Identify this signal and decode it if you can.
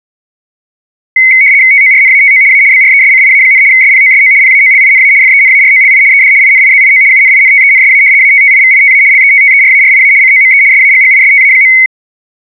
RTTY (75 baud, 170 Hz shift), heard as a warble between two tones, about 2150 Hz centre. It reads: TORNATO A BRESCIA, SPOSO PAOLINA FENAROLI ED INIZIO UNINTENSA ATTIVITA LETTERARIA COME SAGGISTA.